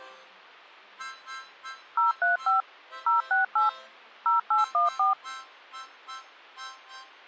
DTMF, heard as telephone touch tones, dialled by machine, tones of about 140 ms. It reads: 035 068 0814